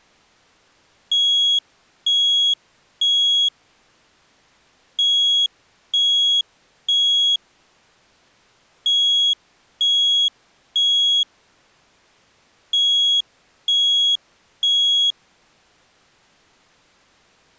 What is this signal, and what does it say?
Alarm pattern, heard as an alarm's beeps, played four times, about 3300 Hz. Temporal three. Smoke or fire, evacuate.